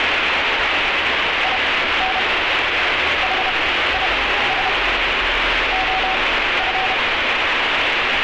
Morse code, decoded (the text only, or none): IN HIS OF